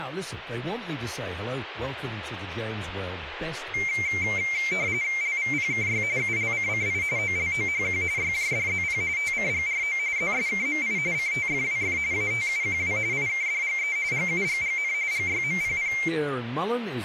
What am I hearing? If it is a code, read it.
RTTY (45.45 baud, 170 Hz shift), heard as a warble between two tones, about 2200 Hz centre, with speech in English. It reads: LVPKY ULCCI OLOHQ YJDZP TCGRO ZSKMI CTFWF ATUQW IKDGE GUGGN GYMPP